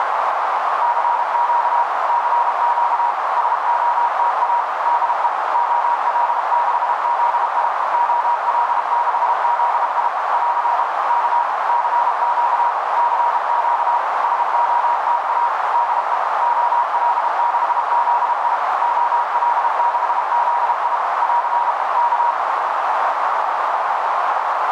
Morse code, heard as a keyed tone, machine-sent, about 32 wpm, 950 Hz, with heavy radio static and a narrow filter. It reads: CQ CQ SOTA DE OL6ZI OL6ZI <AR> K CQ CQ SOTA DE OL6ZI OL6ZI <AR> K